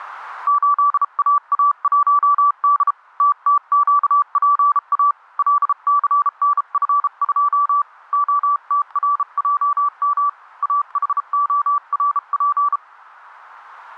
Morse code, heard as a keyed tone, hand-sent with a bug key, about 33 wpm, 1160 Hz, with static crashes. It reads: 8AA1D TTQPA LCNF2 OTRJM AHORP